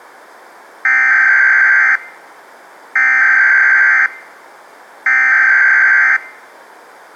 Emergency Alert System (SAME) tones (header bursts), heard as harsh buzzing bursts, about 520.83 baud.